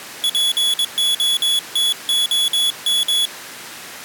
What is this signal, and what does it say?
Morse code (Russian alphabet), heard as a high beeper, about 22 wpm, 3400 Hz. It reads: ПОТОМ